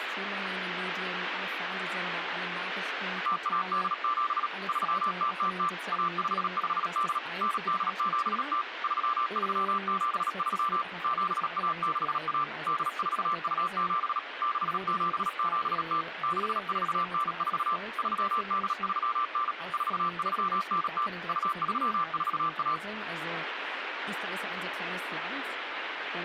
Morse code (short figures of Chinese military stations), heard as a keyed tone, machine-sent, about 37 wpm, 1180 Hz, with radio static. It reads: 0187 3000 1558 9870 3373 7161 8427 6770 6494 3839 4390 2341